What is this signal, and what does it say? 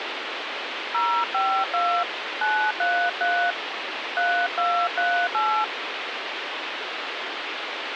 DTMF, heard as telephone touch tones, dialled by hand, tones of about 300 ms, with phone line noise. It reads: 052 933 3238